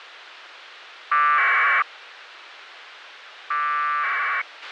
Packet radio (AX.25, as in APRS), 1200 baud, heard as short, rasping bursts, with radio hiss and a squelch burst at the end.